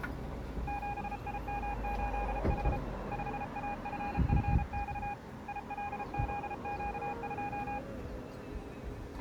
Morse code, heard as a keyed tone, hand-sent with a paddle, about 33 wpm, 820 Hz, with street noise. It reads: 7IM8H 5AFFX ILZQ2